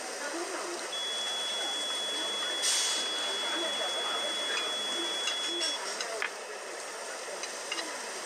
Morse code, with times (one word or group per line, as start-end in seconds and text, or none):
none